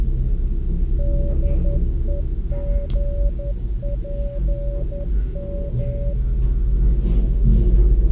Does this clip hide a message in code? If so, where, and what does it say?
Yes: Morse code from 0.9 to 6.2 s, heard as a keyed tone, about 11 wpm, 570 Hz, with the noise inside a lift. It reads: DEGPM